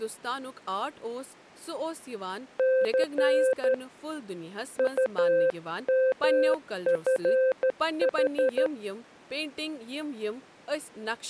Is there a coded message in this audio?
Yes: Morse code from 2.5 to 8.7 s, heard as a keyed tone, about 12 wpm, 520 Hz, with speech in Kashmiri. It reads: C UMFH